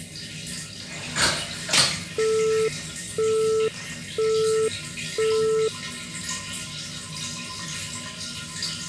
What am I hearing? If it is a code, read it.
Telephone call progress tone (single-tone plan, as in Europe, Japan and elsewhere), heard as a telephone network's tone, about 440 Hz, 0.5 s on and 0.5 s off, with the noise of a restroom. Busy tone.